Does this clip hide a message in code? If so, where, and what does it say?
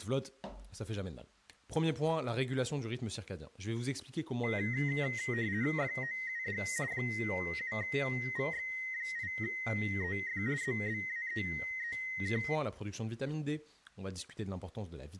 Yes: RTTY (50 baud, 170 Hz shift) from 4.4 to 12.6 s, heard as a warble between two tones, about 1950 Hz centre, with speech in French. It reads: FOUD 7VX8EF ZBAEEK